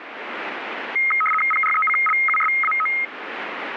RTTY (75 baud, 850 Hz shift), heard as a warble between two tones, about 1700 Hz centre, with radio static. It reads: PRECLUSAO